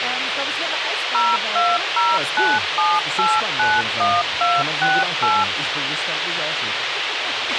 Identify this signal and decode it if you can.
DTMF, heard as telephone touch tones, dialled by machine, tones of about 220 ms, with radio hiss and a squelch burst at the end. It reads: 02097891268